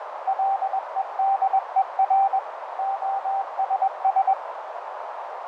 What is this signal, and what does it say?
Morse code, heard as a keyed tone, machine-sent, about 21 wpm, 780 Hz, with radio static, fading and a narrow filter. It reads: LEDER OSS